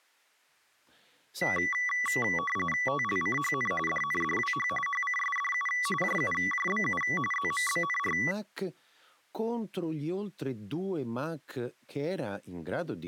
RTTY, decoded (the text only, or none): TLCHN DNDWH HCSDU JUJBU ZMBNR